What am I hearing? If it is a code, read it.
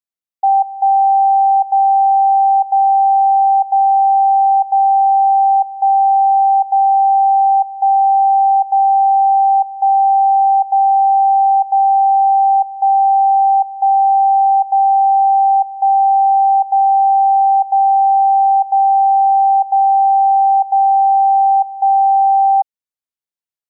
Radio time signal (DCF77), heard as a tone whose level steps once a second, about 780 Hz. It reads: 1 0 0 0 0 1 0 1 0 1 0 0 1 1 0 1 0 0 0 0 0 1